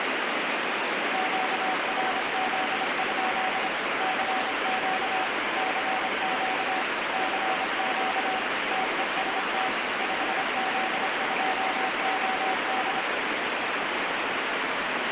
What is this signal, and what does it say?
Morse code, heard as a keyed tone, machine-sent, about 26 wpm, 750 Hz, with heavy radio static. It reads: QRZ? CQ CQ CQ TEST 5Z2OD